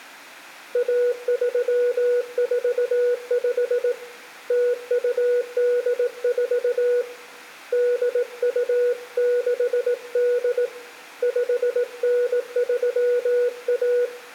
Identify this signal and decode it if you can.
Morse code (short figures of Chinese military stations), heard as a keyed tone, hand-sent with a paddle, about 18 wpm, 490 Hz, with room echo. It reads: 1345 0284 8268 5931